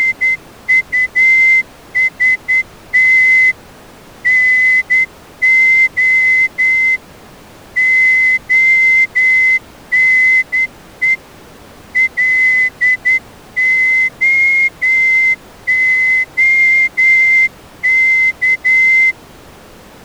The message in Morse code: … NO ONE LOOK

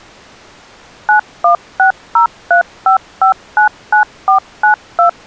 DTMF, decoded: 916035599492

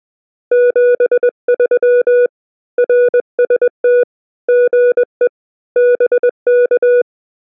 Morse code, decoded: 73 RST GE BK

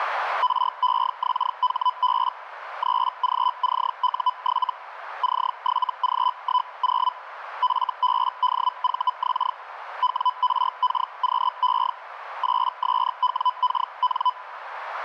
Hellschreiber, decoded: REXHB 3GCU7 C7G10 FBDVX WRKQE 8SWKN

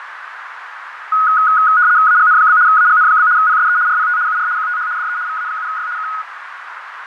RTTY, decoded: AGN? AGN? PSE RPT UR QTH DE VA7Y K

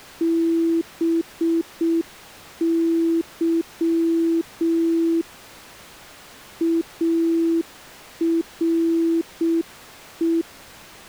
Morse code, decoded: BY ARE

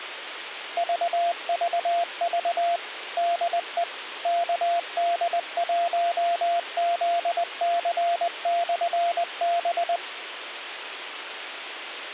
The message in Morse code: VVV DE KD1ZC/B

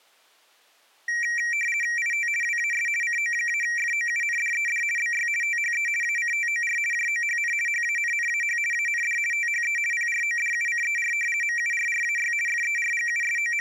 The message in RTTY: IT WAS CO-FOUNDED BY THE ACTOR JOHN HANNAH AND THE PRODUCER MURRAY …

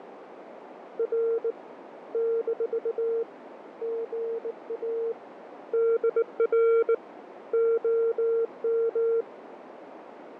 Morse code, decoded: R - GA DR OM

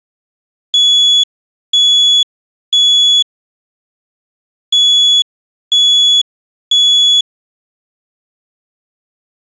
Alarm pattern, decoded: temporal three

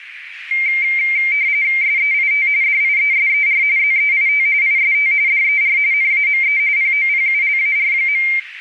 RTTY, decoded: SEIT DIESER ZEIT IST DER NAME POPULAR.

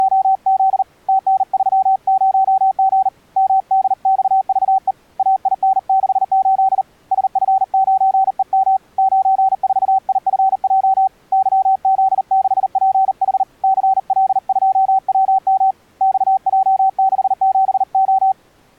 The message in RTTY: none

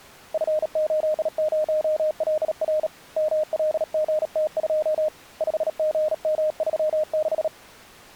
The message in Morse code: F80LR MLGT2 5GM36

